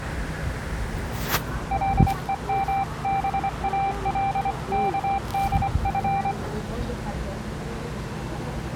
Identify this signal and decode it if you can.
Morse code (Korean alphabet), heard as a keyed tone, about 25 wpm, 790 Hz, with the noise of a residential street. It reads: 감독은